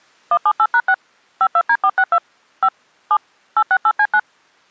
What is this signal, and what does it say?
DTMF, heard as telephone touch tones, dialled by machine, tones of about 60 ms. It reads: 178#6 52D462 5 7 868C9